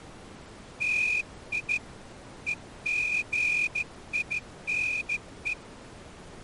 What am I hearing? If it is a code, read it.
Morse code (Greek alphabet), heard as a whistle, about 14 wpm. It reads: ΤΙ ΕΓΙΝΕ